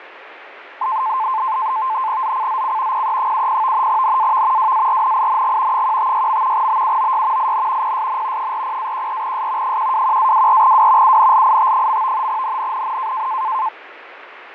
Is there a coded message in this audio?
Yes: NAVTEX (SITOR-B), 100 baud, 170 Hz shift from 0.8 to 13.7 s, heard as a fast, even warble, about 960 Hz centre, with radio static and fading. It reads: ZCZC PE70 NAV WARNING 156. BUOY IN PSN 40-14S 121-24W UNLIT. NNNN